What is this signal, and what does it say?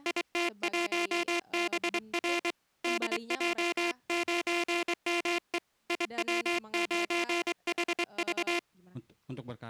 Morse code, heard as a buzzer, hand-sent with a straight key, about 24 wpm, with speech in Indonesian. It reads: IT1BR DJ9ME IW9HV